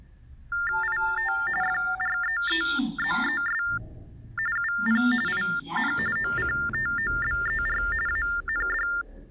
TTY/TDD text telephone tones (45.45 baud Baudot), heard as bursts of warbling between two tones, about 400 Hz shift, 1600 Hz centre, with the noise inside a lift. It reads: IT FREEZES UP IN OCTOBER AND